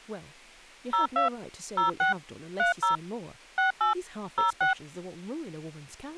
DTMF, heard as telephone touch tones, dialled by machine, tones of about 130 ms, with speech in English. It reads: 02 06 30 68 06